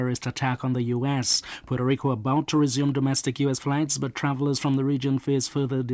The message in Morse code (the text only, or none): none